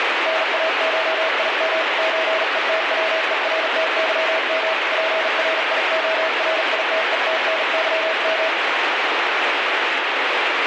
Morse code (Russian alphabet), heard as a keyed tone, hand-sent with a bug key, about 40 wpm, 640 Hz, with heavy radio static. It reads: НАШИМ ЧЕТВЕРТЫМ ПРИОРИТЕТНЫМ